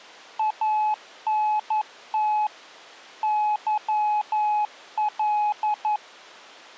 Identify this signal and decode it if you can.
Morse code, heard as a keyed tone, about 11 wpm, 850 Hz. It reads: ANT YL